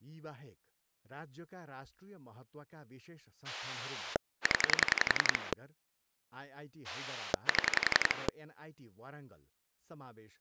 Pulse dialling, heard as a rotary dial, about 11 pulses a second, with speech in Nepali. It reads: 0 7